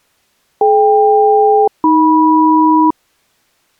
Aircraft SELCAL, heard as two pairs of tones. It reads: DK-AM